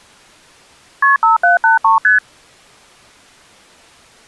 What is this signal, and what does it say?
Multi-frequency trunk signalling (R1, as on North American trunks), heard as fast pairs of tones, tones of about 140 ms. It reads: KP 5783 ST